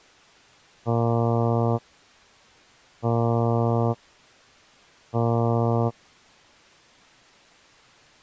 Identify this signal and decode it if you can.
Ship horn signal, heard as a ship's horn, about 120 Hz. 3 short. At sea: I am operating astern propulsion.